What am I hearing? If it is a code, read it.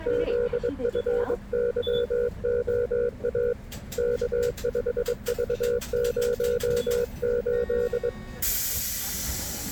Morse code, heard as a keyed tone, hand-sent with a paddle, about 22 wpm, 480 Hz, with the noise inside a bus. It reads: ZFYOA K5V08